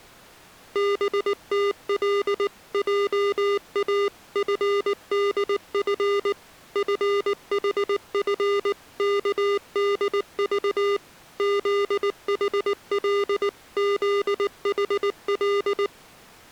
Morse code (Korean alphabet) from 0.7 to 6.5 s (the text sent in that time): 덕호는